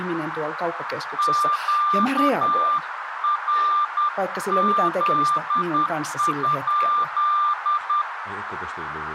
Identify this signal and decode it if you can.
Morse code, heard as a keyed tone, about 10 wpm, 1190 Hz, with radio static, a narrow filter and speech in Finnish. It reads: QRZ?